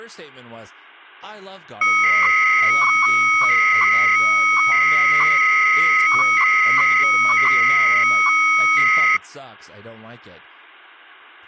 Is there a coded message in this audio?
Yes: 300-baud modem data (Bell 103 tones) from 1.8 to 9.2 s, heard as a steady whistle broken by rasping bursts, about 300 baud, 200 Hz shift, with speech in English.